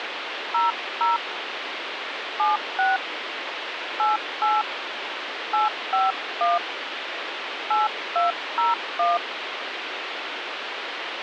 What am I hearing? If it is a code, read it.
DTMF, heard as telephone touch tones, dialled by hand, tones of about 170 ms, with phone line noise. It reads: 00 76 88 851 8201